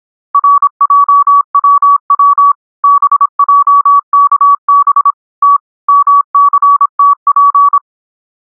Morse code, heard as a keyed tone, machine-sent, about 26 wpm, 1140 Hz. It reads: RJWW BJKB T MCTP